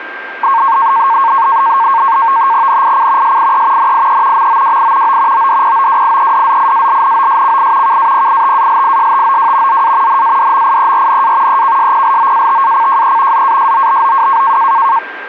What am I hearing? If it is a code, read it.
NAVTEX (SITOR-B), 100 baud, 170 Hz shift, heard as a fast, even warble, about 1000 Hz centre, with radio static and a steady whistle near 1590 Hz. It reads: NIC SIE NIE MOWI O ODPOWIEDZIALNOSCI KAPITALISTOW ZA NADMIERNA EKSPLOATACJE ZASOBOW